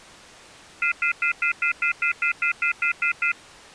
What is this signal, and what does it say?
Telephone call progress tone (North American plan), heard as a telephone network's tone, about 1400, 2050, 2450, 2600 Hz, 0.1 s on and 0.1 s off. Off-hook warning tone.